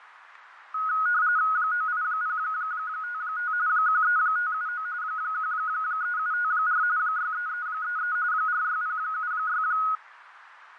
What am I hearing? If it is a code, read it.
RTTY (45.45 baud, 170 Hz shift), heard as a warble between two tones, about 1360 Hz centre, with radio static and fading. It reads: 98055 13579 13754 63333 46076